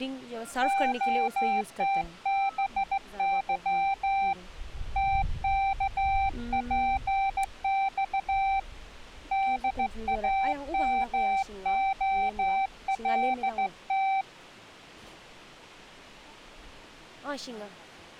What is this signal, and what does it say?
Morse code, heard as a keyed tone, hand-sent with a straight key, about 15 wpm, 780 Hz. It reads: OTBY TKPX DAMOLT